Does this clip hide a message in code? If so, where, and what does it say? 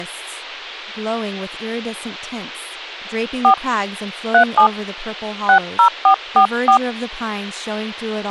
Yes: DTMF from 3.4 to 6.8 s, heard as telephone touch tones, dialled by hand, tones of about 90 ms, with speech in English. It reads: 4 37 60444